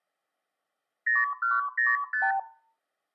Multi-frequency trunk signalling (R2, with the far end's replies), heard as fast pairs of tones, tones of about 180 ms, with room echo. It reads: 0105